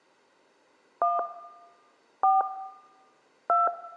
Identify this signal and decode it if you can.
DTMF, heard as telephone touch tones, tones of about 180 ms, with room echo. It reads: 1 4 2